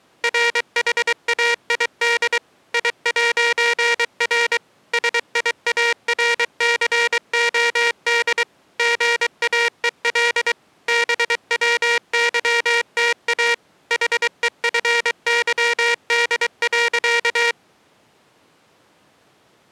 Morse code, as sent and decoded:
.-. .... .- .. -.. / .. .----. .-. / ... .. .- .-. -.-. --- -.. / --. .- . .-.. / -... .-- -.-- - .- / .... . ..-. -.-- -.. .-.-.-
RHAID I'R SIARCOD GAEL BWYTA HEFYD.

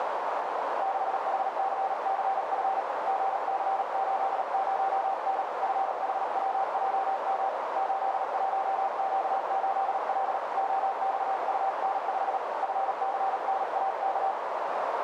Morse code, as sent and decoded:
-.... .... -.-. -.-. ..-. / --. -.-. ---.. ----- -. / ..-. .... .-- .--- -- / ---.. .---- --.- ---.. .-.. / --- -..- ..- -. ..... / ..-. -.-. -. .- -.-
6HCCF GC80N FHWJM 81Q8L OXUN5 FCNAK

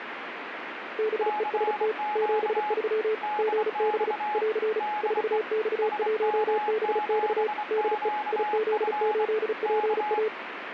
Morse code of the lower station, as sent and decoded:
-... . ... - / --... ...-- / --. -... / .-.-. / ....- -..- .---- -... -..- / -.. . / .. --.. ---.. .--. .-
BEST 73 GB <AR> 4X1BX DE IZ8PA

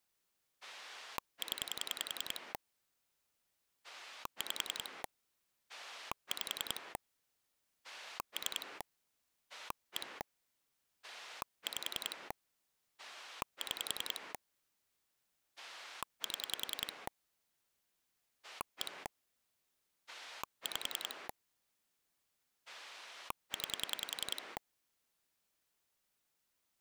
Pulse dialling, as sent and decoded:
10 / 5 / 5 / 3 / 1 / 5 / 6 / 7 / 1 / 5 / 9
0 5 5 3 1 5 6 7 1 5 9

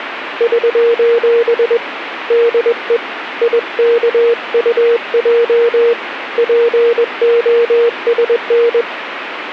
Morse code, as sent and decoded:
...---... / -.. . / .. -.- ..- .--- / .--. --- ... -.
<SOS> DE IKUJ POSN

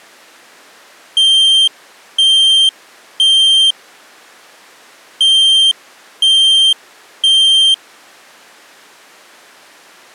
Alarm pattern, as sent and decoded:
3 beeps and a pause
temporal three

